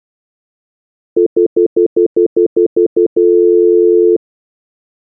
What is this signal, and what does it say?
Telephone call progress tone (North American plan), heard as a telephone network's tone, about 350, 440 Hz, 0.1 s on and 0.1 s off. Stutter dial tone.